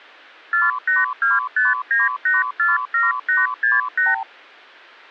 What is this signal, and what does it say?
Multi-frequency trunk signalling (R2, with the far end's replies), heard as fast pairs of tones, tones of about 170 ms. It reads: 48259847868